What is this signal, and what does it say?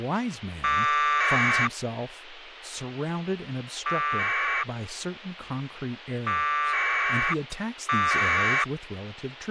Packet radio (AX.25, as in APRS), 1200 baud, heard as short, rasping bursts, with radio hiss and speech in English.